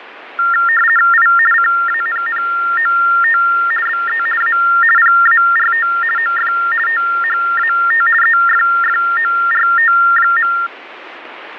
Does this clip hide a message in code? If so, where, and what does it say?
Yes: RTTY (50 baud, 450 Hz shift) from 0.4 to 10.7 s, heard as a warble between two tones, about 1600 Hz centre, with radio static. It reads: I CANNOT BE A PART OF THAT EFFORT.